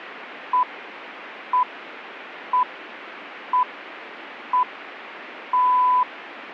Radio time signal (six pips, as the Greenwich Time Signal), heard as pips.